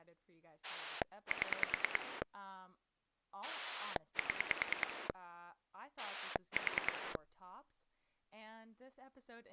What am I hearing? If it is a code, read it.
Pulse dialling, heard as a rotary dial, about 9 pulses a second, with speech in English. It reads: 7 7 4